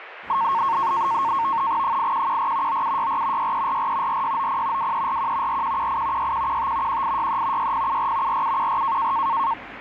NAVTEX (SITOR-B), 100 baud, 170 Hz shift, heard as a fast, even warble, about 1000 Hz centre, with radio static and street noise. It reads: 8114 9764 6344 4690 2341 4118 6115 1863 6074 4714